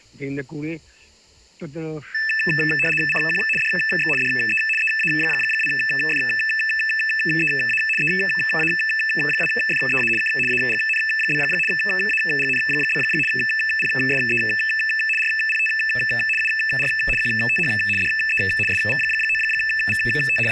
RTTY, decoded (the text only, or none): CQ DX DE EA2FEA EA2FEA K AGN? AGN? PSE RPT UR QTH DE SV9VT …